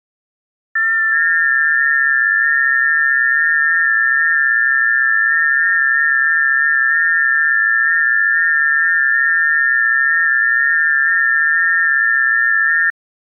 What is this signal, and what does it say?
FT8 (several signals at once), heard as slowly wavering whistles, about 6.25 baud.